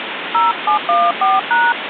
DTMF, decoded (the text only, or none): 0714#